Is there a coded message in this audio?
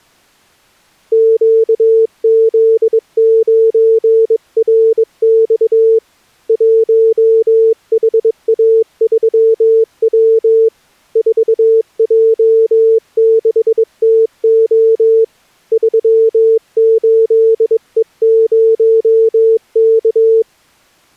Yes: Morse code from 1.1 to 20.5 s, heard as a keyed tone, hand-sent with a bug key, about 22 wpm, 450 Hz. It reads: QZ9RX 1HA3W 4J6TO 38E0K